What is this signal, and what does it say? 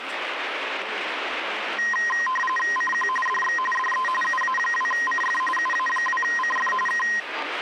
RTTY (45.45 baud, 850 Hz shift), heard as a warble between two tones, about 1460 Hz centre, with radio static and the noise of a restaurant. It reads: CQ DX DE UA2CF UA2CF K